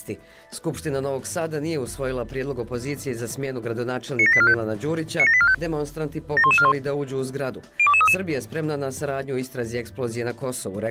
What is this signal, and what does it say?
Five-tone selective call (ZVEI), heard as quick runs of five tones, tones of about 70 ms. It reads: 97845 97845 71141 02233